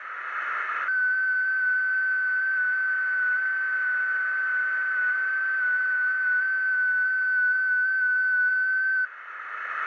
FT8 (one signal), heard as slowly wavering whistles, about 6.25 baud, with radio static, a narrow filter and room echo.